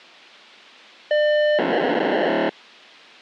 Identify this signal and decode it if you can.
POCSAG pager data (1200 baud), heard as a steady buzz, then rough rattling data.